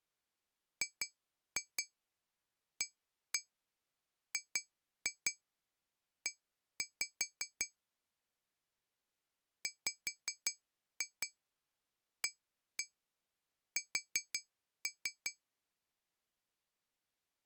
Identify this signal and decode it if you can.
Tap code, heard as taps on glass, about 5 knocks a second. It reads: GAGE WAS